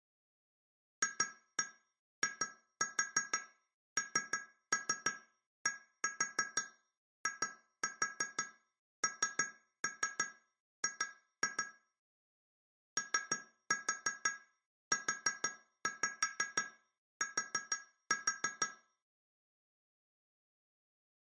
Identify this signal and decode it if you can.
Tap code, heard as taps on glass, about 6 knocks a second, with room echo. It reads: FINDING OUT